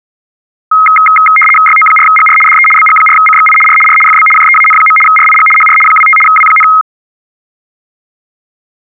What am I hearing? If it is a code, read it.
RTTY (75 baud, 850 Hz shift), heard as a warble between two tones, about 1700 Hz centre. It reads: YO4GR DE BG4CXI R R FB JEAN. RIG HR 25 W,